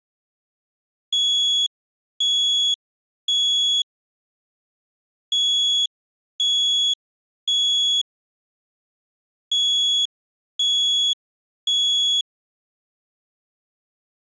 Alarm pattern, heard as an alarm's beeps, played three times, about 3350 Hz. Temporal three. Smoke or fire, evacuate.